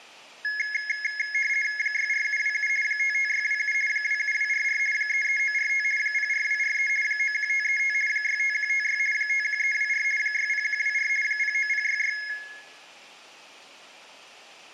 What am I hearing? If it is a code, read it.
RTTY (50 baud, 450 Hz shift), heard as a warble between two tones, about 1900 Hz centre, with room echo. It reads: 64727 55627 27244 33945 04243 91535 65156 51324 60124 09066